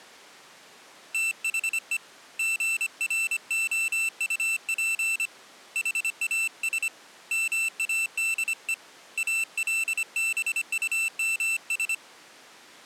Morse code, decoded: THE GROUP HAS MADE ALBUMS

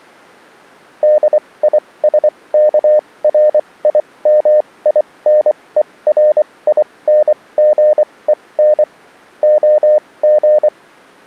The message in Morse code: DISKRIMINERINGEN OG

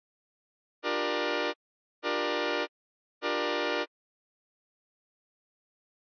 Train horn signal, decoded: 3 short

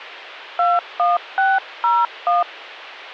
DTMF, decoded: 21601

